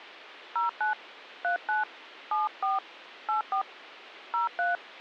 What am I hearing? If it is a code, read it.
DTMF, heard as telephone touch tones, dialled by hand, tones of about 130 ms. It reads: 09 39 74 84 03